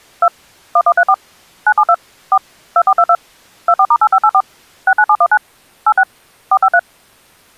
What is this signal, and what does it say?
DTMF, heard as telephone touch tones, dialled by machine, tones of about 60 ms. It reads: 2 1134 972 4 2422 24*8584 69719 86 453